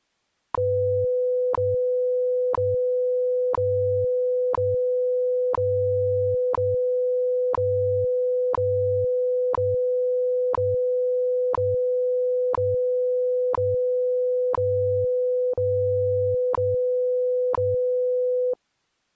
Radio time signal (WWV, Colorado), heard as ticks, one a second.